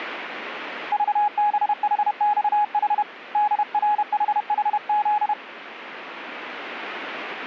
Morse code, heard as a keyed tone, hand-sent with a paddle, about 31 wpm, 840 Hz, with radio static. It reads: VBHXH DRHHZ